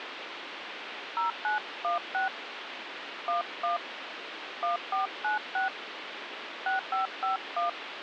DTMF, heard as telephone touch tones, dialled by hand, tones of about 130 ms, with phone line noise. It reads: 0916 11 1496 6551